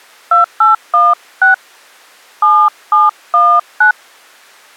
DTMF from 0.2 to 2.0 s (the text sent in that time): 2816